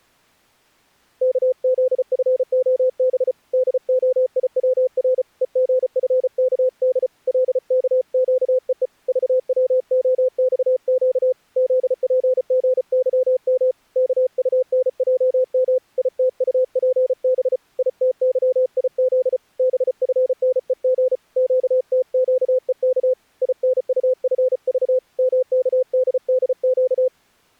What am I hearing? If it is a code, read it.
Morse code, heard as a keyed tone, hand-sent with a paddle, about 34 wpm, 510 Hz. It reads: KZFOB DOIWR EGFKD LKQEE VWOXQ ZPGYM KUNJM ITUPB ITYIZ BFNEG QTQEK INUFV MKDDQ